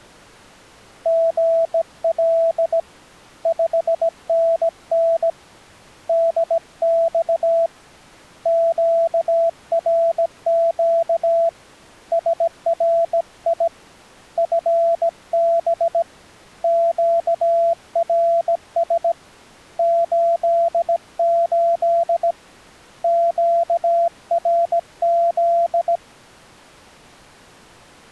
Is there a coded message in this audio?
Yes: Morse code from 1.0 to 26.0 s, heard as a keyed tone, hand-sent with a bug key, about 17 wpm, 670 Hz. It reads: GL 5NN DX QRQ SRI FB QRS 88 QRZ